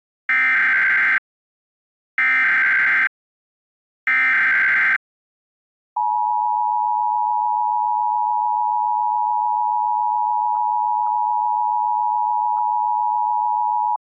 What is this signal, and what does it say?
Emergency Alert System (SAME) tones (header bursts, then the 853 and 960 Hz attention tone), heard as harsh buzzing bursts, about 520.83 baud.